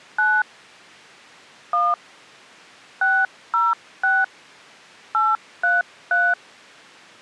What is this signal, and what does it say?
DTMF, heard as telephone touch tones, dialled by hand, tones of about 210 ms. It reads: 9 1 606 833